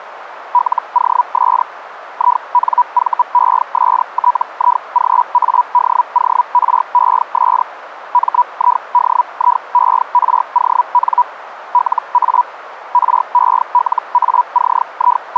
Hellschreiber (Feld-Hell, 122.5 baud), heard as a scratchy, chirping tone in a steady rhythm, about 980 Hz, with radio static. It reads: LOS INVESTIGADORES MIDIERON LA …